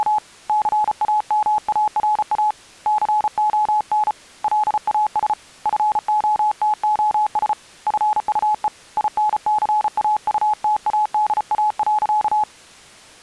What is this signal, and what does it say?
Morse code, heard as a keyed tone, hand-sent with a paddle, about 34 wpm, 850 Hz. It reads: … CAMARA CON LAS FOTOS FUE INCAUTADA.